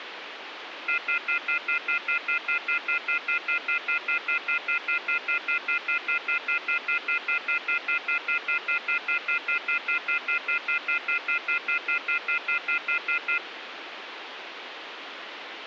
Telephone call progress tone (North American plan), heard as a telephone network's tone, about 1400, 2050, 2450, 2600 Hz, 0.1 s on and 0.1 s off, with phone line noise. Off-hook warning tone.